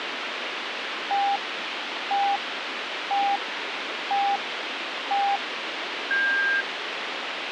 Radio time signal (five pips and a higher one, as on Chinese radio), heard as pips, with radio hiss.